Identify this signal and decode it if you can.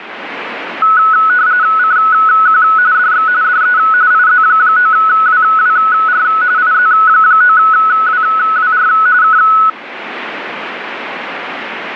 RTTY (45.45 baud, 170 Hz shift), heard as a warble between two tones, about 1380 Hz centre, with radio static. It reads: CQ DX DE IZ9WWR IZ9WWR K